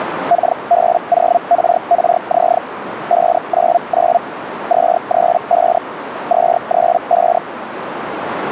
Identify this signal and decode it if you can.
Hellschreiber (Feld-Hell, 122.5 baud), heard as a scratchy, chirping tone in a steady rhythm, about 690 Hz, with radio static and a narrow filter. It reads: KB0RRZ 599 235 235